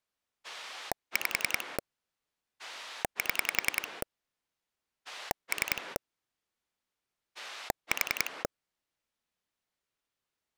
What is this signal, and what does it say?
Pulse dialling, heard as a rotary dial, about 10 pulses a second. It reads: 5 7 3 4